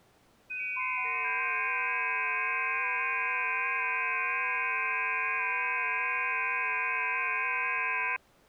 FT8 (several signals at once), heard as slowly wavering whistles, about 6.25 baud.